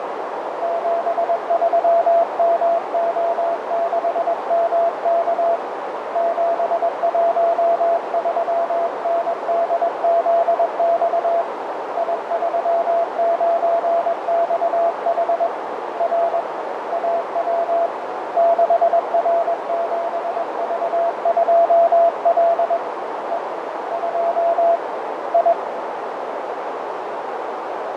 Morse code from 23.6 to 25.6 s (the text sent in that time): 2 I